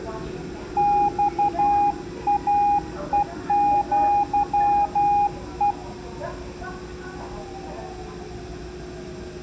Morse code (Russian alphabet), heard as a keyed tone, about 12 wpm, 820 Hz, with room echo and the noise inside a subway train. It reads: ЬАЕЪЕ